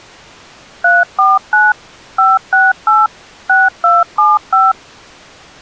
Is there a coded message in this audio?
Yes: DTMF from 0.8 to 4.7 s, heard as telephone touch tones, dialled by machine, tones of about 190 ms. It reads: 349 568 6275